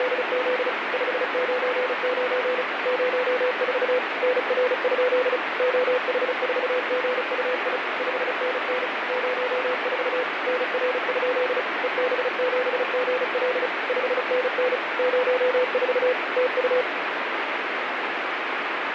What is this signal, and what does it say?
Morse code, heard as a keyed tone, machine-sent, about 35 wpm, 500 Hz, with heavy radio static. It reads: … 599 04 NR? OH4GUI 5NN 04 NR? EB7GL 5NN 04 TU